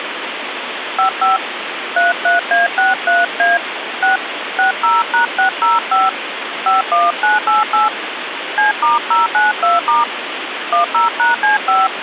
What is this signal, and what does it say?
DTMF, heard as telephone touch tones, dialled by hand, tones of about 150 ms, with phone line noise. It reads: 55 33A63A 6 60#605 51988 C*092* 10#C5